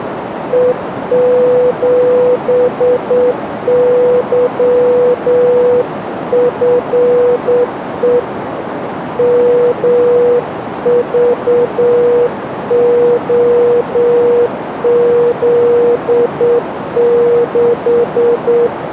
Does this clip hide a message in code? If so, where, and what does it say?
Yes: Morse code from 0.5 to 18.7 s, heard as a keyed tone, hand-sent with a straight key, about 8 wpm, 490 Hz, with radio static and a narrow filter. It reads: E7YFE MVOZ6